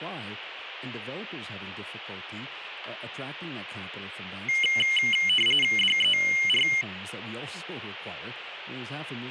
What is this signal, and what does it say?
RTTY (45.45 baud, 850 Hz shift), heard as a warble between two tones, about 2550 Hz centre, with radio static and speech in English. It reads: DER